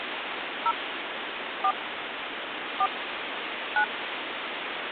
DTMF, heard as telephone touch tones, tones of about 90 ms, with phone line noise. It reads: 0 4 4 9